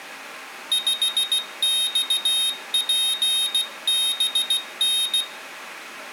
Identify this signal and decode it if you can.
Morse code, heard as a high beeper, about 16 wpm, 3700 Hz, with room echo. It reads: 5XPBN